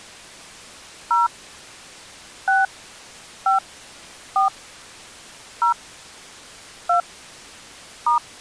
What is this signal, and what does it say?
DTMF, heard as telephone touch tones, dialled by hand, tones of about 160 ms. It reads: 0 6 5 4 0 2 *